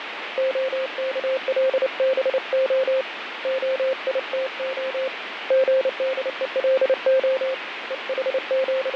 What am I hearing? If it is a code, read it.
Morse code (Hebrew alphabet), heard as a keyed tone, hand-sent with a paddle, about 29 wpm, 530 Hz, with radio static and fading. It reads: הכלבה היתה גדולה …